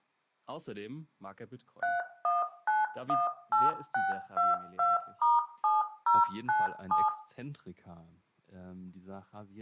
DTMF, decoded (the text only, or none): 31918622*7097